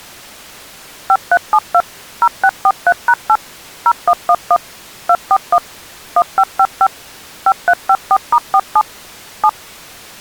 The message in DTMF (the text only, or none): 5372 0643#8 0111 241 1555 5354*47 7